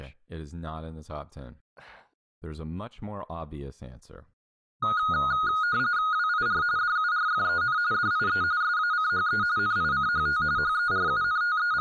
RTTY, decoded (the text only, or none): WIR DURFEN DIE SACHE NICHT …